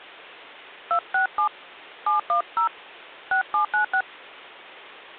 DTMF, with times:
0.9-1.5 267
2.1-2.7 710
3.3-4.0 6796

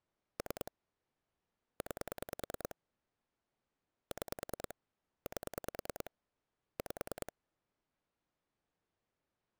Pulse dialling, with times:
0.4-0.7 3
1.8-2.8 9
4.1-4.7 6
5.3-6.1 8
6.8-7.3 5

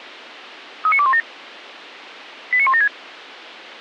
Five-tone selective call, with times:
0.9-1.2 39217
2.5-2.9 89176

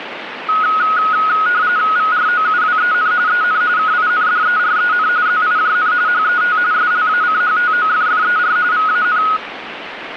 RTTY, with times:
2.0-3.1 VROUWEN
3.3-3.6 EN
3.8-5.1 KINDEREN
5.3-5.9 ZIJN
6.1-6.6 HET
6.7-8.6 SLACHTOFFER
8.7-9.2 VAN

